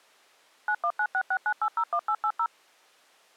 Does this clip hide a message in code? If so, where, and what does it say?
Yes: DTMF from 0.7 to 2.5 s, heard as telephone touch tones, dialled by machine, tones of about 70 ms. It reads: 919669801880